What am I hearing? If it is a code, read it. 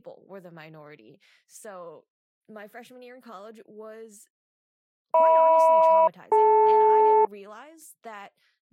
Aircraft SELCAL, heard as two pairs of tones, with speech in English. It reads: HM-DL